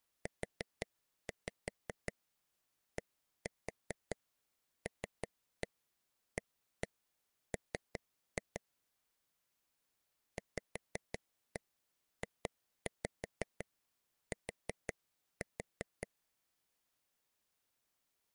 Tap code, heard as taps on a table, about 5 knocks a second. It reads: UDLAM VJT